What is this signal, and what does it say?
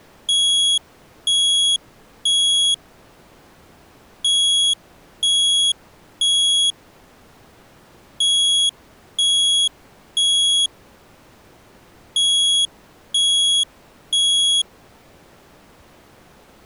Alarm pattern, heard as an alarm's beeps, played four times, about 3350 Hz. Temporal three. Smoke or fire, evacuate.